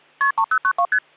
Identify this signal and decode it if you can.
Multi-frequency trunk signalling (R1, as on North American trunks), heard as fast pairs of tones, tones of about 70 ms. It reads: KP 3092 ST